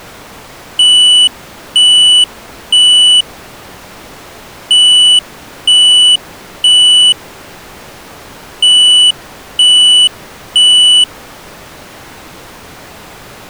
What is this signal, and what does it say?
Alarm pattern, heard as an alarm's beeps, played three times, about 2950 Hz. Temporal three. Smoke or fire, evacuate.